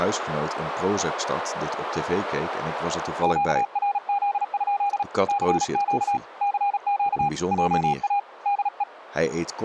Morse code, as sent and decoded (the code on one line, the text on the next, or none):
--.- .-. --.. ..--.. / -.-. --.- / -.-. --.- / .--- .- / -.. .
QRZ? CQ CQ JA DE